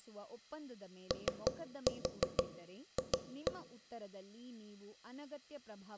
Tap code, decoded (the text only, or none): OF